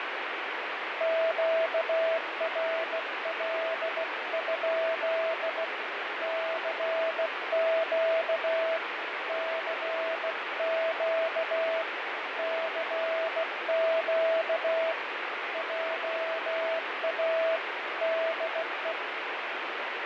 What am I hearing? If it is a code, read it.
Morse code, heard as a keyed tone, hand-sent with a bug key, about 16 wpm, 650 Hz, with heavy radio static. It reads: QRL? CQ CQ CQ JA DE